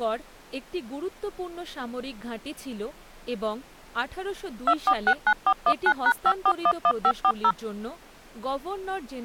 DTMF, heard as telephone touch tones, dialled by machine, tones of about 60 ms, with speech in Bangla. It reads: 2469419#5411540